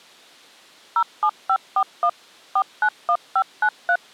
DTMF, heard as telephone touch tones, dialled by machine, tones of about 70 ms. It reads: 07541 491593